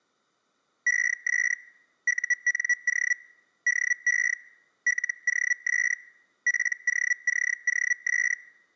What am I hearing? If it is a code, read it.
Hellschreiber (Feld-Hell, 122.5 baud), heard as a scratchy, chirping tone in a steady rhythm, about 1950 Hz. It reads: ES UNO DE LOS POCOS